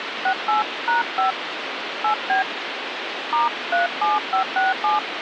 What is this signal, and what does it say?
DTMF, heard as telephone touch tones, dialled by hand, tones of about 140 ms, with phone line noise. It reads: 68#5 8B *37567